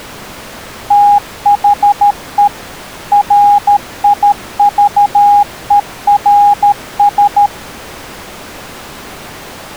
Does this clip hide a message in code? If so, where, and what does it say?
Yes: Morse code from 0.8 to 7.5 s, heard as a keyed tone, machine-sent, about 13 wpm, 820 Hz. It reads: THE RIVERS